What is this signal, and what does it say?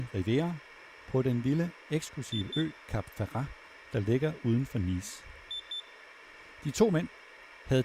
Beep code, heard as a piezo beeper, played twice, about 3550 Hz, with room echo and speech in Danish. 2 short. In AMI BIOS tables: memory parity error; in IBM BIOS tables: self-test error shown on screen; in Dell tables: no memory detected.